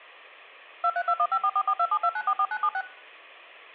DTMF, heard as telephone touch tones, dialled by machine, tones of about 60 ms. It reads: 23215444272944976